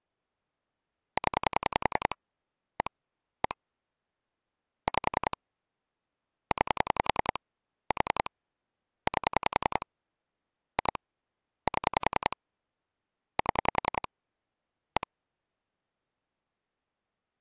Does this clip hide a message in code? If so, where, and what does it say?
Yes: pulse dialling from 1.2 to 15.0 s, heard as clicks on a phone line, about 10 pulses a second. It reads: 0 1 1 5 9 4 8 2 7 7 1